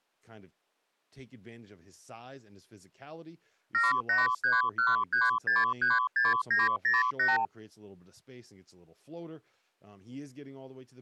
Multi-frequency trunk signalling (R2, with the far end's replies), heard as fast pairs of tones, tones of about 170 ms, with speech in English. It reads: 78313636908